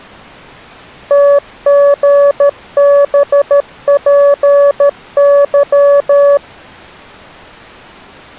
Morse code, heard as a keyed tone, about 13 wpm, 570 Hz. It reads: TGBPY